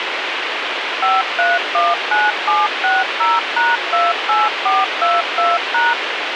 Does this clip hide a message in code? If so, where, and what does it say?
Yes: DTMF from 1.0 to 5.9 s, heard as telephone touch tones, dialled by machine, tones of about 190 ms, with radio hiss. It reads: 5319760#28422#